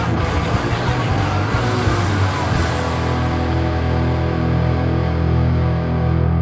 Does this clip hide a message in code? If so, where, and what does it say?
No.